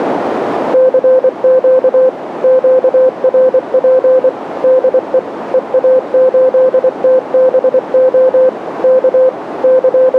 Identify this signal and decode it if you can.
Morse code, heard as a keyed tone, machine-sent, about 24 wpm, 520 Hz, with radio static and a narrow filter. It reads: CQ QRP DE EA8TBO K …